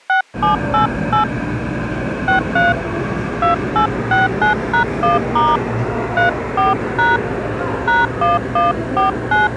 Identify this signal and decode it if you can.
DTMF, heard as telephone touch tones, dialled by hand, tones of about 150 ms, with the noise of a subway station. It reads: 6788 63 2869#1* 34# #1149